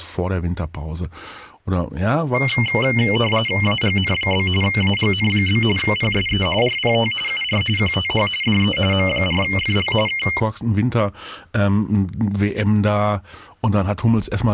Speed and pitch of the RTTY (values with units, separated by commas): 45.45 baud, 850 Hz shift, 2550 Hz centre